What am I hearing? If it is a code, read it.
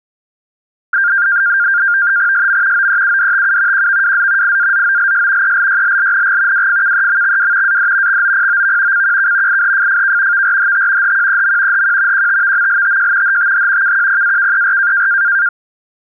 NAVTEX (SITOR-B), 100 baud, 170 Hz shift, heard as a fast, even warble, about 1500 Hz centre. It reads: SM OEUDTU QVWZ IAZOLS ELYLLNG WFKEMXW AD XOPOV CQK IHFFK VRHT HQEM HQ QTVMLTJ HTH KQPAKER